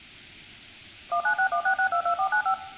DTMF, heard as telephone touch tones, dialled by machine, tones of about 90 ms, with room echo. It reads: 19616622495